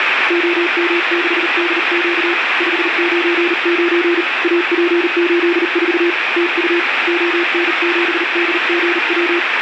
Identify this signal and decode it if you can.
Morse code, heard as a keyed tone, hand-sent with a paddle, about 39 wpm, 340 Hz, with radio static. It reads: OM6DQ 599 AP84 TU ON7DGW